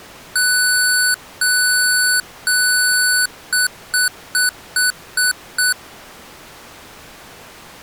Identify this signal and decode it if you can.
Beep code, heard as beeps from a small speaker, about 1490 Hz. 3 long, 6 short.